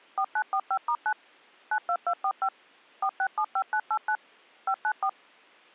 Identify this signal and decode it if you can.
DTMF, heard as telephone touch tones, dialled by machine, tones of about 70 ms. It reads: 4945*9 92245 4675989 594